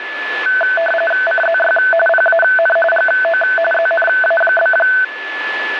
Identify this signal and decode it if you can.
RTTY (45.45 baud, 850 Hz shift), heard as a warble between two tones, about 1090 Hz centre, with radio static and a steady whistle near 1730 Hz. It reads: CZY PAN GO ZNA?